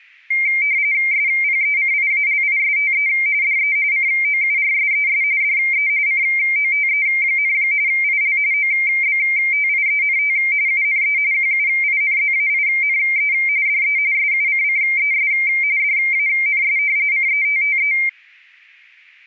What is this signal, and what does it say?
RTTY (45.45 baud, 170 Hz shift), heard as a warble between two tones, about 2200 Hz centre. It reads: SPECIALISTE DE COURSES DE COTE, IL OBTIENT UNE QUINZAINE DE SUCCES DANS CETTE